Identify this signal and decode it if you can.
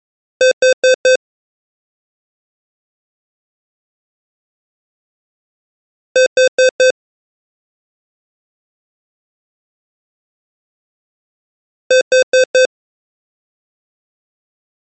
Alarm pattern, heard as an alarm's beeps, played three times, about 510 Hz. Temporal four. Carbon monoxide.